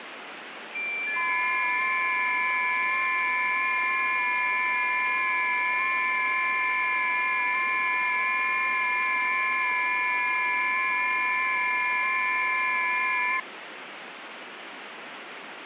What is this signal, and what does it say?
FT8 (several signals at once), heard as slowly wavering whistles, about 6.25 baud, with radio static.